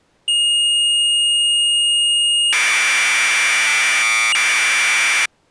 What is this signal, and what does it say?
Commodore tape loading (standard loader), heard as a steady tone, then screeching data.